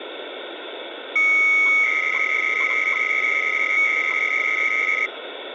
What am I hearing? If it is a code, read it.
300-baud modem data (Bell 103 tones), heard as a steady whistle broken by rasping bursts, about 300 baud, 200 Hz shift, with phone line noise.